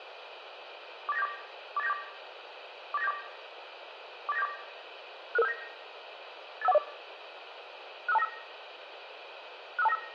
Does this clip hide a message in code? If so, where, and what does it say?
Yes: five-tone selective call (EIA) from 1.1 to 10.0 s, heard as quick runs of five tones, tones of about 30 ms, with radio hiss. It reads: 48974 48974 48974 48974 66579 85140 65295 65295